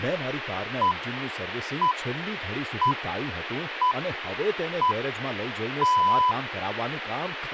Radio time signal (six pips, as the Greenwich Time Signal), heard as pips, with radio hiss and speech in Gujarati.